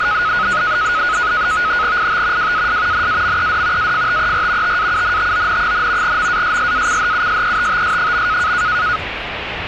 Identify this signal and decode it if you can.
NAVTEX (SITOR-B), 100 baud, 170 Hz shift, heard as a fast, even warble, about 1360 Hz centre, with radio static and the noise inside a car. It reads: IT WAS NAMED AFTER TAUNTON, MASSACHUSETTS.